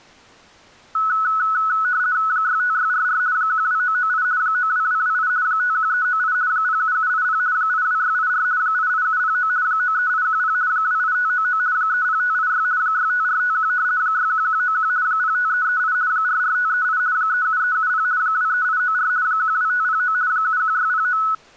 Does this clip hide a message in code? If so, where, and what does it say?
Yes: RTTY (50 baud, 170 Hz shift) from 0.9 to 21.3 s, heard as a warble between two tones, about 1380 Hz centre. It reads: 65644 12998 92228 51398 07780 82684 88709 93810 28599 30586 65451 61191 05338 44538 37370 23894 12509 71609